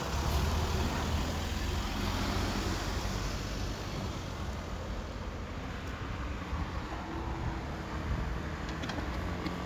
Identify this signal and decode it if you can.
Street noise. There is no code.